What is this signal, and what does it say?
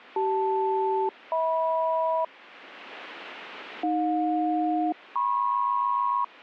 Aircraft SELCAL, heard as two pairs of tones. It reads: CL-HM AJ-MP